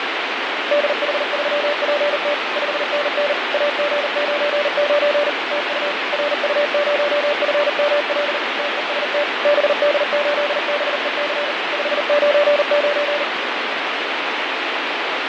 Morse code, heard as a keyed tone, machine-sent, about 39 wpm, 580 Hz, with heavy radio static and fading. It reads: DH3PT 5NN AG99 TU RU0FML TEST BD8BEC 599